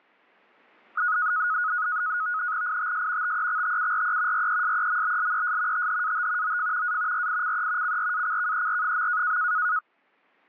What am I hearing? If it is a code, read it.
NAVTEX (SITOR-B), 100 baud, 170 Hz shift, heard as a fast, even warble, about 1360 Hz centre. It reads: ITS TEXTURE RESEMBLES THAT OF A RICE CRACKER.